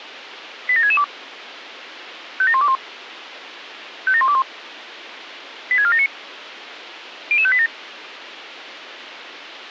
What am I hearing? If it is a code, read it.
Five-tone selective call (ZVEI), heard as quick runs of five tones, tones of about 70 ms, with radio hiss and a squelch burst at the end. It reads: 87662 57121 57121 86479 00587